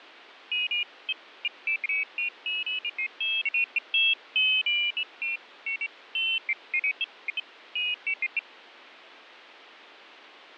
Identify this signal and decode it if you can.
Pairs of high tones at irregular times, with radio static and fading. There is no code.